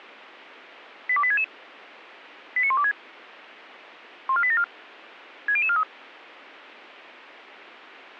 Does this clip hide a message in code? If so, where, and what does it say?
Yes: five-tone selective call (ZVEI) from 1.1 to 5.8 s, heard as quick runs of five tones, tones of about 70 ms. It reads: 82866 89126 14874 60043